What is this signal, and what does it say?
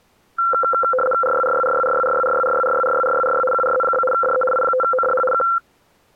RTTY (75 baud, 850 Hz shift), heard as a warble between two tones, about 940 Hz centre. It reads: RYRYRYRYRYRYRYRYRYRYRY QRZ? DE I5ODH K